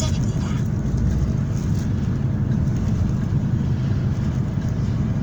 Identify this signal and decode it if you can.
The noise inside a car. There is no code.